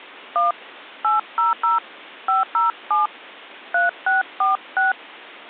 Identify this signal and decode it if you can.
DTMF, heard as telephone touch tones, dialled by hand, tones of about 150 ms. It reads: 1 800 507 3646